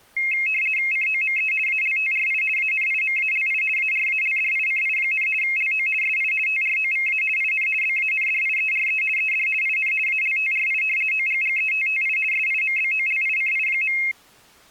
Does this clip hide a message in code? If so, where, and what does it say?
Yes: RTTY (50 baud, 450 Hz shift) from 0.2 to 14.1 s, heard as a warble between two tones, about 2350 Hz centre. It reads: COME ALTRI ANIMALI ARALDICI, LO SI TROVA IN BANDIERE ED IN ALTRI OGGETTI SIMBOLICI.